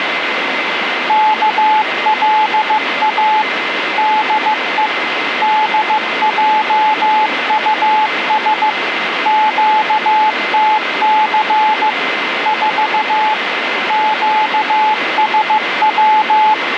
Morse code, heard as a keyed tone, machine-sent, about 15 wpm, 860 Hz, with radio static and a steady whistle near 2060 Hz. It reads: KLA DE DJUS QTC 4 QSW